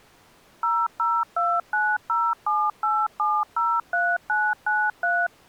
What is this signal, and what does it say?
DTMF, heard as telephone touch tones, dialled by machine, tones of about 240 ms. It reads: 0029078703993